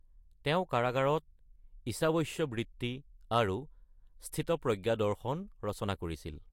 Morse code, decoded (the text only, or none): none